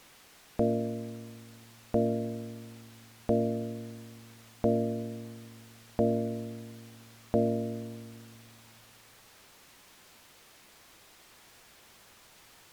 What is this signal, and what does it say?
Clock strike, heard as a bell. 6. Six o'clock.